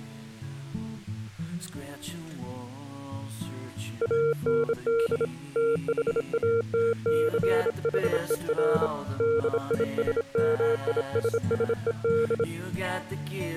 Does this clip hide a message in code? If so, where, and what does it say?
Yes: Morse code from 4.0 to 12.5 s, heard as a keyed tone, hand-sent with a bug key, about 26 wpm, 460 Hz. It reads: AND THATCHER DISMISSED